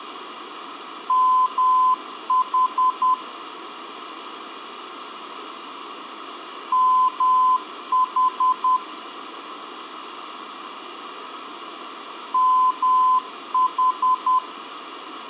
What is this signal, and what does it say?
Morse code, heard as a keyed tone, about 10 wpm, 1020 Hz, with radio hiss. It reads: MH MH MH